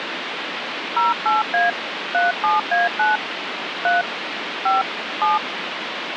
DTMF, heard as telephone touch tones, dialled by hand, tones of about 160 ms, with phone line noise. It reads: 08A 37A9 3 5 7